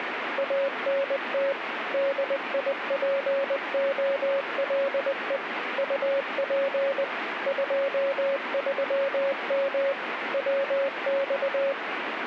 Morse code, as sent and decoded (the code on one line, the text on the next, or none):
.- -. - / -.. .. .--. --- .-.. . / ..- .--. / ..--- ...-- -- / .-- -..-
ANT DIPOLE UP 23M WX